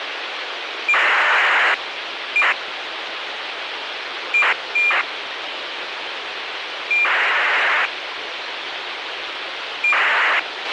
ACARS aircraft data, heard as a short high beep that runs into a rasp, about 2400 baud, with radio hiss and a squelch burst at the end.